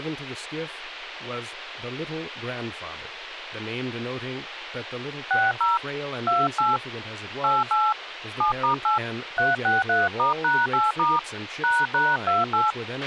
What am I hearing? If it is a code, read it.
DTMF, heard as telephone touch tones, dialled by hand, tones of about 160 ms, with radio hiss, a squelch burst at the end and speech in English. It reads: 60 28 88 7*8 363*#8* ##28